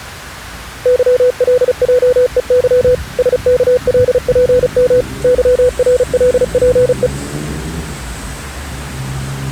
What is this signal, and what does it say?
Morse code, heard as a keyed tone, machine-sent, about 35 wpm, 500 Hz, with street noise. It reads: YLJEY SKLPM YRLPE